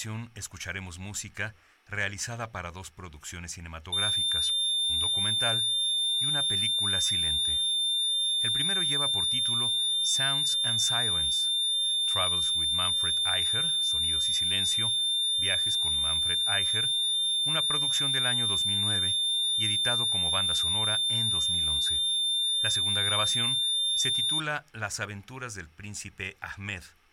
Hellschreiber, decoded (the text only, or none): none